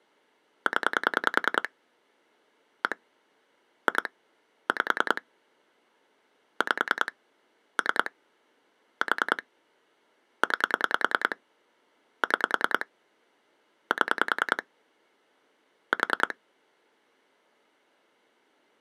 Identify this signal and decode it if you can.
Pulse dialling, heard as clicks on a phone line, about 10 pulses a second. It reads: 0 1 2 5 5 3 4 9 6 7 4